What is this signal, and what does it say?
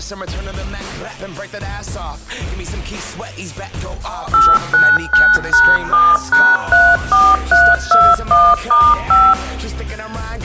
DTMF, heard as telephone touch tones, dialled by machine, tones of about 230 ms. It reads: 899#7#34321*5